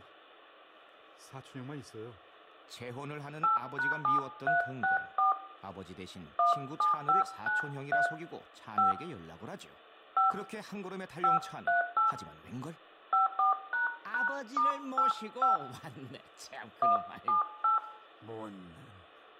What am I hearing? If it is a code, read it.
DTMF, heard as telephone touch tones, dialled by hand, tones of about 140 ms, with room echo and speech in Korean. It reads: 8#7364 17593 5 5 538 54##*85 178